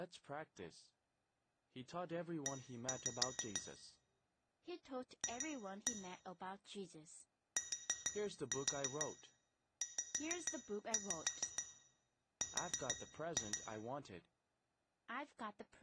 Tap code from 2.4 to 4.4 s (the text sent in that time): E